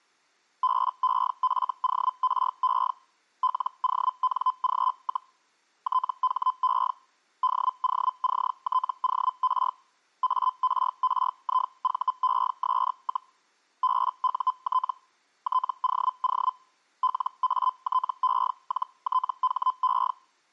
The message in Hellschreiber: BEFORE LONG, THE DOCTOR ARRIVES, BUT TOO LATE-THE

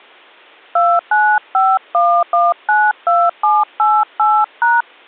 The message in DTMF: 2951192788#

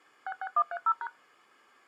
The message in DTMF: 66130#

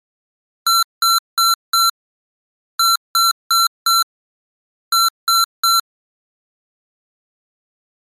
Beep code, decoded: 4-4-3

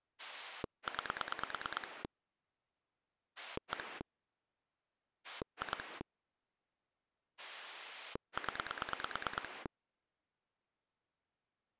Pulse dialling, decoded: 9 1 2 0

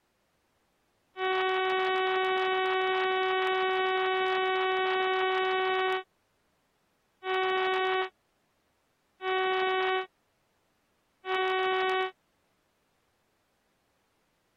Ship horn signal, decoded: 1 long, 3 short

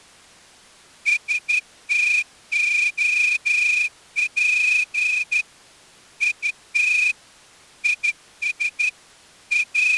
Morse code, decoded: STOP IT IS …

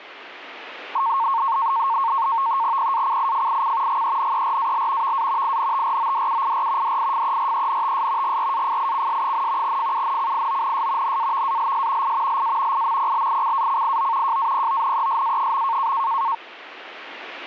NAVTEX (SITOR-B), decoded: PACIFIC GENERAL VA INTRODUIR DIFERENTS GRAFICS, FUNCIONS NAVALS I LA IMPLICACIO JAPONESA.

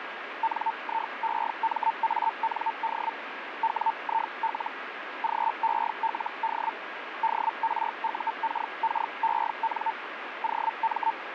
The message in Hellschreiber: NIEMAND WIL GELD DRUKKEN OM

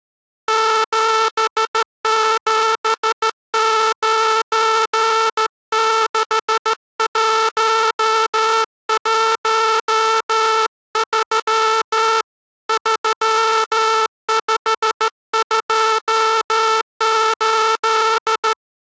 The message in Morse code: 7796113 3528

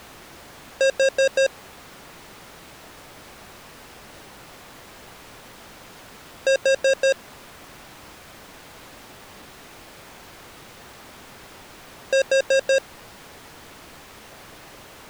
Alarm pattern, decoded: temporal four

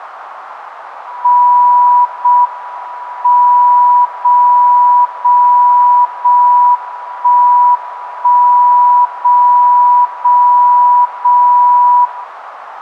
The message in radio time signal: 0 M 0 0 0 1 1 0 0 0 0

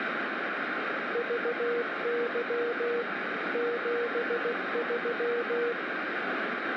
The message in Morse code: VY 73

